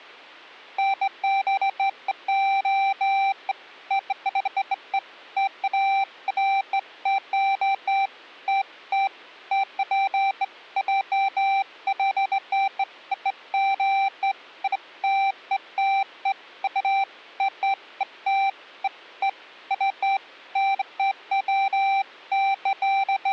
Beeps of irregular length. There is no code.